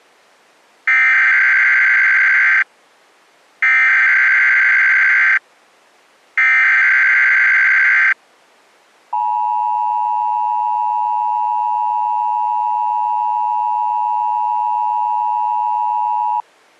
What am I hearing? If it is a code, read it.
Emergency Alert System (SAME) tones (header bursts, then the 853 and 960 Hz attention tone), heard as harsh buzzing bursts, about 520.83 baud.